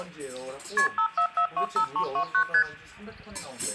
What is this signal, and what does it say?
Multi-frequency trunk signalling (R1, as on North American trunks), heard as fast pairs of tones, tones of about 90 ms, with the noise of a restaurant. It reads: KP 54425329 ST